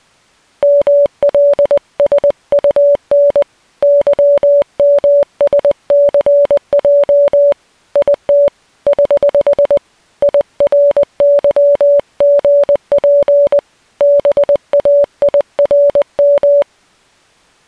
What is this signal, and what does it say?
Morse code, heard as a keyed tone, hand-sent with a paddle, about 20 wpm, 570 Hz. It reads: MLSUN YMSCJ IT <HH> IRYGP BAIRM